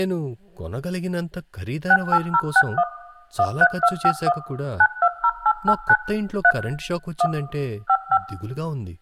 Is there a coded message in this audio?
Yes: DTMF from 1.9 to 8.2 s, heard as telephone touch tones, dialled by machine, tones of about 60 ms, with speech in Telugu. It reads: 68061 13251 920889 3 1 55